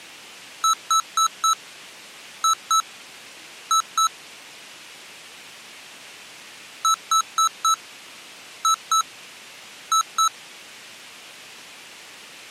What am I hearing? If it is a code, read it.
Beep code, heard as beeps from a small speaker, played twice, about 1310 Hz. 4-2-2. In Phoenix BIOS tables: shutdown test failure.